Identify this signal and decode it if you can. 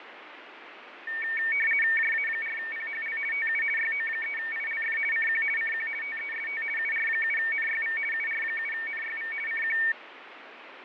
RTTY (50 baud, 450 Hz shift), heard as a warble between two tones, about 2050 Hz centre, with radio static and fading. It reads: JA4PHL TU YO3ILF CQ CQ TEST UR7NYV UR7NYV CQ